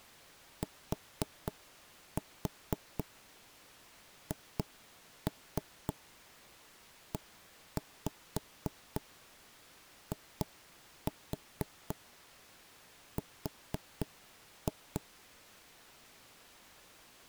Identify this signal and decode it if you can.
Tap code, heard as knocks on wood, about 4 knocks a second. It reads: THEIR